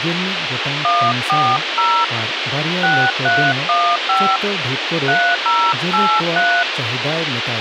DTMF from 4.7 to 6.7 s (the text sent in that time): 3083